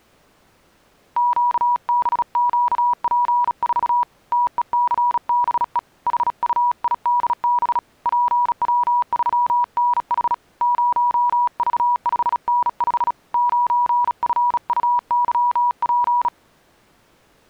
Morse code, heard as a keyed tone, hand-sent with a bug key, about 36 wpm, 970 Hz. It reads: QBQP4 TECBE HUIDB PW3NH 0V5N5 9FUYP